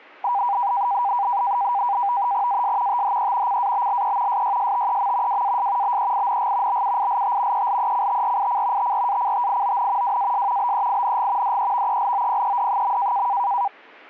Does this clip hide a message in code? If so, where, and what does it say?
Yes: NAVTEX (SITOR-B), 100 baud, 170 Hz shift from 0.2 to 13.7 s, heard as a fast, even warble, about 880 Hz centre. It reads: AS THE CABLE SYSTEM WAS BEING BUILT ELECTRIC TRACTION WAS BEING DEVELOPED.